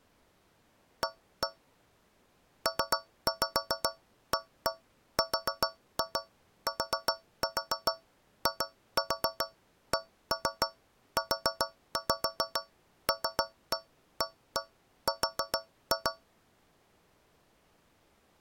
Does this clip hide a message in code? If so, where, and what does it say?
Yes: tap code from 1.0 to 16.3 s, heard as taps on a metal pipe, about 7 knocks a second. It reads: A PARTICULAR